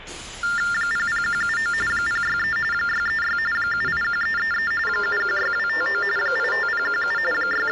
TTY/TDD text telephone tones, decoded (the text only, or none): 00179 063 636 781333 716259 85017 …